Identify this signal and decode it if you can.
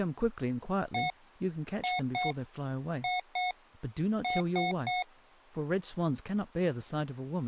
Beep code, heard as beeps from a small speaker, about 730 Hz, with speech in English. 1-2-2-3. In Phoenix BIOS tables: BIOS ROM checksum failure.